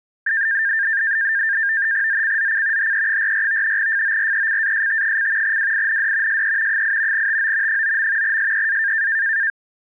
NAVTEX (SITOR-B), 100 baud, 170 Hz shift, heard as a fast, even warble, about 1700 Hz centre. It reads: ZCZC HE44 FORECAST: WIND SE 8 TO 9. SEA